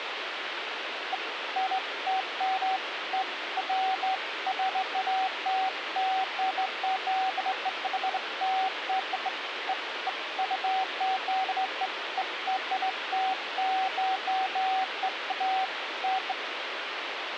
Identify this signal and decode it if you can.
Beeps of irregular length, with phone line noise. There is no code.